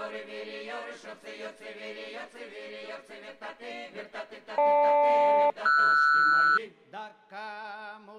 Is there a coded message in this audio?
Yes: aircraft SELCAL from 4.6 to 6.6 s, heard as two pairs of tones. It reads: GL-RS